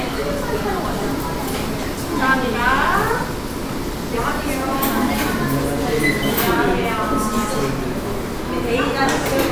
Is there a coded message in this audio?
No, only the noise of a cafe.